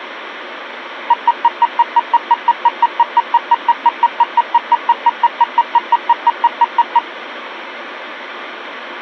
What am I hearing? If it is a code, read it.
Evenly repeated beeps, with phone line noise. There is no code.